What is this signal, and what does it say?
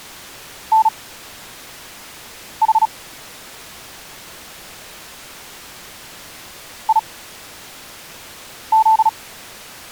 Morse code, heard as a keyed tone, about 36 wpm, spaced as for 5 wpm, 880 Hz. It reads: NH IZ